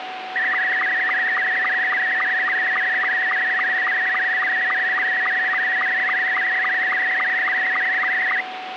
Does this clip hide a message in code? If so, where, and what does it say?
Yes: SSTV (slow-scan television), Scottie S2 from 0.4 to 8.4 s, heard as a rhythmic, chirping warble, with radio static and a steady whistle near 750 Hz.